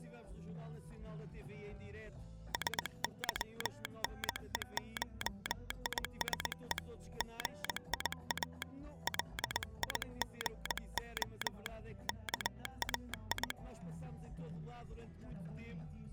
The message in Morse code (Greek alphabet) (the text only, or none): ΣΥΝΕΧΙΣΕ ΓΙΑ ΛΙΓΟ ΚΑΙ